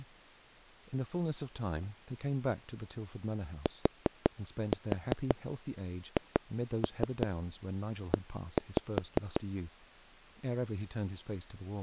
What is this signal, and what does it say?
Tap code, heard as taps on a table, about 5 knocks a second, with speech in English. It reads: THE